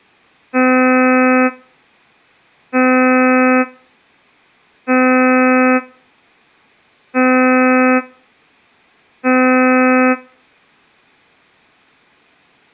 Ship horn signal, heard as a ship's horn, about 260 Hz. 5 short. At sea: I doubt that you are doing enough to avoid a collision.